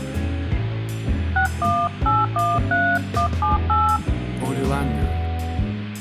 DTMF, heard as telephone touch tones, dialled by hand, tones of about 190 ms. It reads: 61813178